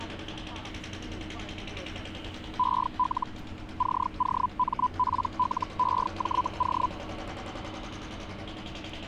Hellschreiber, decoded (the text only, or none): EL COMPLEJO